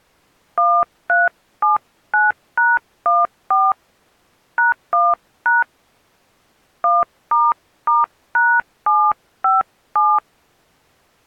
DTMF, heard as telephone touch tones, dialled by hand, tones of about 200 ms. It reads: 1379#14 #1# 1**#757